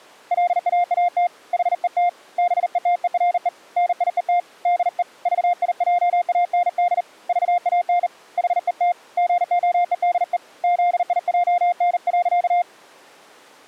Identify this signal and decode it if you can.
Morse code, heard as a keyed tone, hand-sent with a bug key, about 39 wpm, 700 Hz. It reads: LAAT HET BETERE NIET DE VIJAND VAN HET GOEDE ZIJN.